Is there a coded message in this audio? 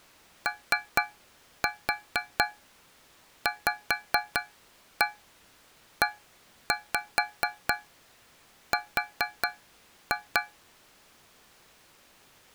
Yes: tap code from 0.5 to 10.6 s, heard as taps on a metal pipe, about 4 knocks a second. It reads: OVER